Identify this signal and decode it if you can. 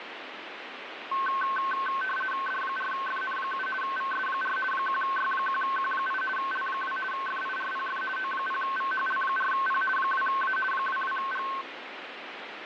RTTY (50 baud, 450 Hz shift), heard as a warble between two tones, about 1300 Hz centre, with radio static. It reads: D4FN7 VS4 1Y1Q8 L2 FIRPF O0VHL4P 2A 22G